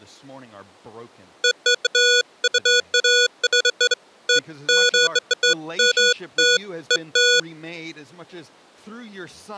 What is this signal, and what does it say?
Beeps of irregular length, with speech in English. There is no code.